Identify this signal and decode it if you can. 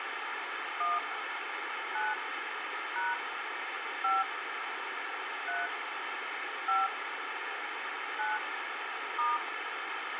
DTMF, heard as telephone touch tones, dialled by hand, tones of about 190 ms, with radio hiss. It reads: 1 9 # 5 3 5 9 *